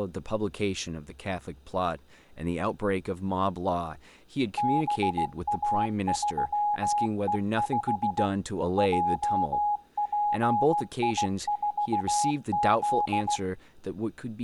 Morse code, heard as a keyed tone, machine-sent, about 16 wpm, 830 Hz, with speech in English. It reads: BA3E5 JPI4Z